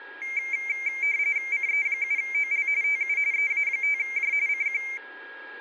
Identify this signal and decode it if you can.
RTTY (45.45 baud, 170 Hz shift), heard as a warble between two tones, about 2200 Hz centre, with a steady whistle near 1640 Hz. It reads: CE7OL TU EA5J CQ